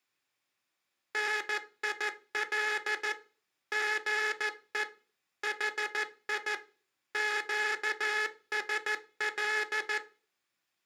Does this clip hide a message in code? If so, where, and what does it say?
Yes: Morse code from 1.1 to 10.0 s, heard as a buzzer, machine-sent, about 14 wpm. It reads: NIL GE HI QSL